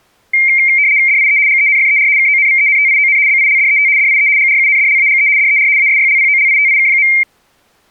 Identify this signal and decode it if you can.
RTTY (75 baud, 170 Hz shift), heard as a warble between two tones, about 2200 Hz centre. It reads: DIE GENFER KONVENTION BILDET DIE GRUNDLAGE DER ASYLPOLITIK.